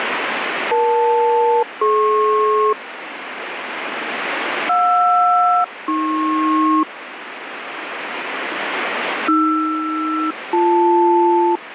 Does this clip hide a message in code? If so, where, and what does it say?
Yes: aircraft SELCAL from 0.7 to 11.6 s, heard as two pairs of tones, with radio static. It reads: EL-DP JR-AP AR-BL